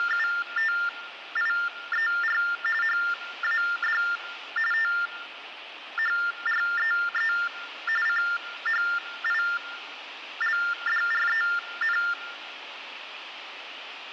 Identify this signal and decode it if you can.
TTY/TDD text telephone tones (45.45 baud Baudot), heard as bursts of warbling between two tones, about 400 Hz shift, 1600 Hz centre, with phone line noise and room echo. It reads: … HAD THREE CHILDREN